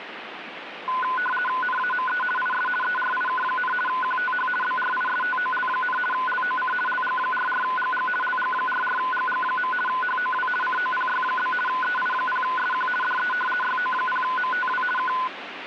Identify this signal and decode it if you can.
RTTY (50 baud, 450 Hz shift), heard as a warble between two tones, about 1250 Hz centre, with radio static. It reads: NAME IS ERIK, QTH BRISTOL, LOC LG44GG LG44GG. HOW COPY? EI0SQ DE YO0MTW K